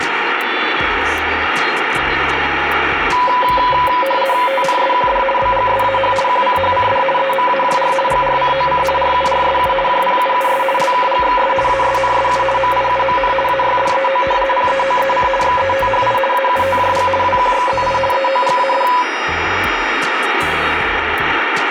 RTTY (50 baud, 450 Hz shift), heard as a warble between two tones, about 770 Hz centre, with radio static and room echo. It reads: TNSQD BGSAH QCHCD EMAJR GRCOC RURSU JPUUS LKGXS ASNSU MIUMN AYDEO PEOEC XETHI AUTJG WQXZI EOGAD